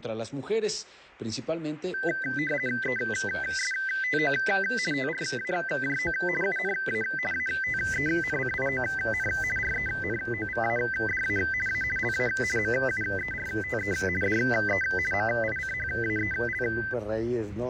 RTTY (50 baud, 450 Hz shift), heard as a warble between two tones, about 1800 Hz centre. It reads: ESTO TRAJO UNA ATENCION RENOVADA A LA MUERTE DE MICHAEL